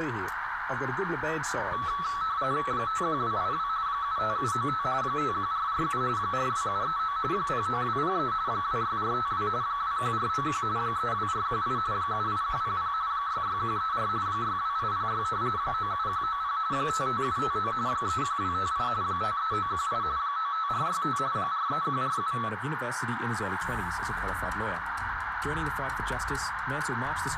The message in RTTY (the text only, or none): 51282 75795 51447 42739 09203 26452 21491 32418 78100 66134 62806 97190 55759 31258 53918 95465 43147